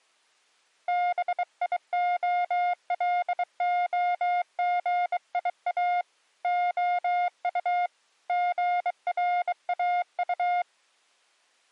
Morse code, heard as a keyed tone, hand-sent with a bug key, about 23 wpm, 710 Hz. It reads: BIOLOGIA OU GRAU